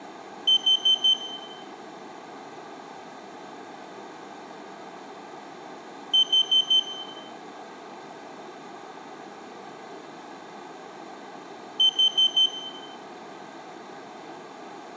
Alarm pattern, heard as an alarm's beeps, played three times, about 3100 Hz, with room echo. Temporal four. Carbon monoxide.